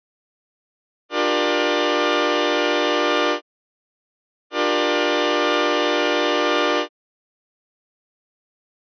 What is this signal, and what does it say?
Train horn signal, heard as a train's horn. 2 long. On North American railways: brakes released, proceed.